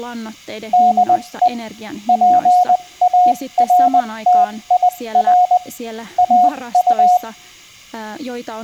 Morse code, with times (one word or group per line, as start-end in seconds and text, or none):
0.7-1.5 DE
2.1-5.6 PARTIR
6.2-7.2 AU